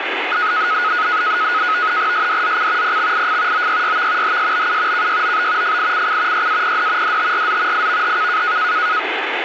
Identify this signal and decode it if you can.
NAVTEX (SITOR-B), 100 baud, 170 Hz shift, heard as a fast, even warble, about 1360 Hz centre, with radio static. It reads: SDZC PXIF OYYV HSBU KYOB FICC YAPD DTRZ IVHK